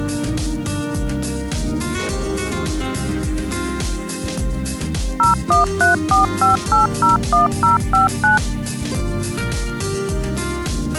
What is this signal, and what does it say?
DTMF, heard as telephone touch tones, dialled by machine, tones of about 140 ms. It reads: 01345801059